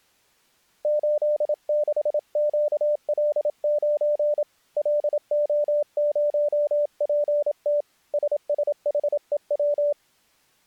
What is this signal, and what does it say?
Morse code, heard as a keyed tone, hand-sent with a paddle, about 27 wpm, 590 Hz. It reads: 86QL9 LO0PT SSHEW